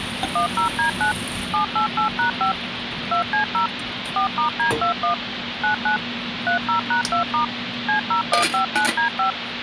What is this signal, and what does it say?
DTMF, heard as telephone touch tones, dialled by machine, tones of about 110 ms, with phone line noise and kitchen noise. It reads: 10D9 788#5 2C0 4*D21 99 30#2* C0159D5